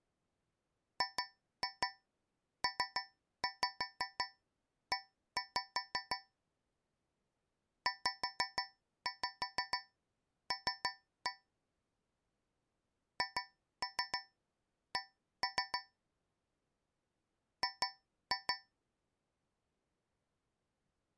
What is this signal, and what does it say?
Tap code, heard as taps on a metal pipe, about 6 knocks a second. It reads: GPE ZL HC G